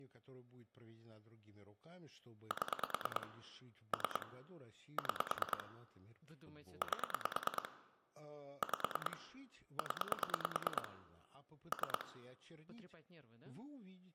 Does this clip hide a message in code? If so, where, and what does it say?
Yes: pulse dialling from 2.5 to 12.0 s, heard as clicks on a phone line, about 9 pulses a second, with room echo and speech in Russian. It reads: 7 3 6 8 5 0 3